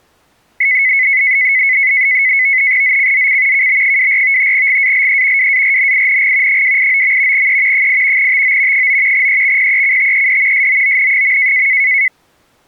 NAVTEX (SITOR-B), 100 baud, 170 Hz shift, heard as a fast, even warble, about 2100 Hz centre. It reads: ZCZC KB24 GALE WARNING 289. E 8 TO 9 EXPECTED SOON.